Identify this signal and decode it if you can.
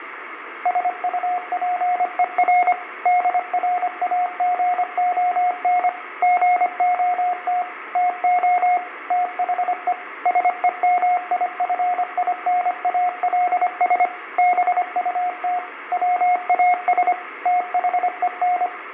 Morse code, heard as a keyed tone, machine-sent, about 25 wpm, 720 Hz, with radio static, fading and room echo. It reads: SUPER DRAGON GOT TO THE SEMIFINALS BUT WAS THEN